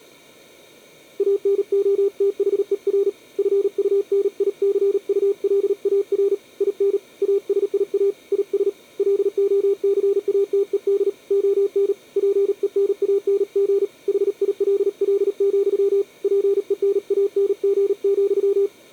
Morse code, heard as a keyed tone, hand-sent with a paddle, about 38 wpm, 400 Hz. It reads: ANOTHER FUNICULAR IN ASIA IS LOCATED ON PENANG HILL, PENANG,